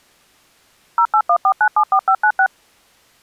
DTMF, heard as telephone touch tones, dialled by machine, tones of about 70 ms. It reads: 0814974596